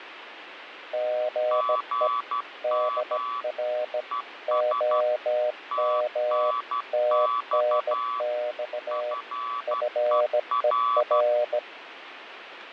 Morse code, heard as two keyed tones, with radio static and fading. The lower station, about 17 wpm, 610 Hz: GE DR OM TNX FER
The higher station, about 12 wpm, 1140 Hz: GM ES TNX FER